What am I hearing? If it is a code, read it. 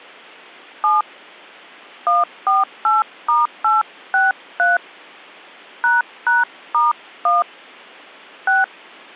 DTMF, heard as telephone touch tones, dialled by hand, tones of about 170 ms. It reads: 7 148*863 ##*1 6